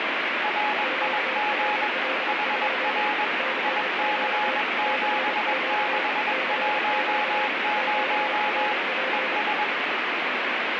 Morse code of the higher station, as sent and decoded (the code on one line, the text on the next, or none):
.-. .. --. / .... .-. / .. -.-. --... -.... .---- ----- / . ...
RIG HR IC7610 ES